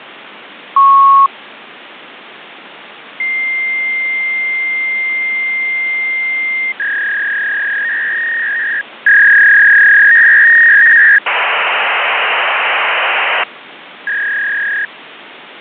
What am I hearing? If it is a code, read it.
Fax machine handshake, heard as a beep, a long tone, a warble and hiss, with phone line noise.